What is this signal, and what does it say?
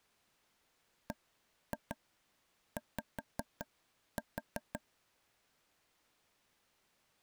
Tap code, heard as taps on a table, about 5 knocks a second. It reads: BY